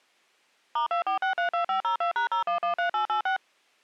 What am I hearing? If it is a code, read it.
DTMF, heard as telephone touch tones, dialled by machine, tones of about 110 ms. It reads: *24632502#0113886